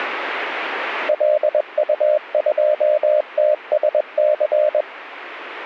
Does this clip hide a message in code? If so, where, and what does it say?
Yes: Morse code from 1.0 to 4.9 s, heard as a keyed tone, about 21 wpm, 600 Hz. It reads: LU2TSC